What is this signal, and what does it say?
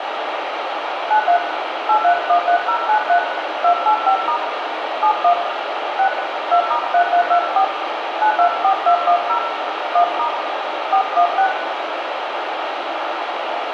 DTMF, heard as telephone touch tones, dialled by hand, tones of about 90 ms, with radio hiss and room echo. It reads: 93 8313093 285* 71 6 2*3324 924210 1* 416